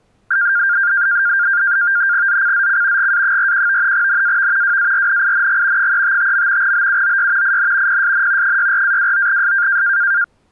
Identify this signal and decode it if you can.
NAVTEX (SITOR-B), 100 baud, 170 Hz shift, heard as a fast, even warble, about 1500 Hz centre. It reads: ZCZC GA41 NAV WARNING 355. BUOY IN PSN 64-29S